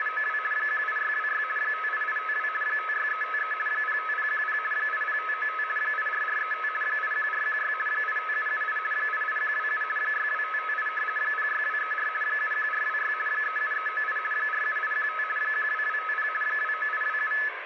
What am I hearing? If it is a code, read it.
RTTY (50 baud, 450 Hz shift), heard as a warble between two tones, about 1500 Hz centre, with radio static and room echo. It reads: … 18626 58852 56353 05010 80595 84435 81416 85778 88127 62558 06234 71426 37398 47815 12250 29827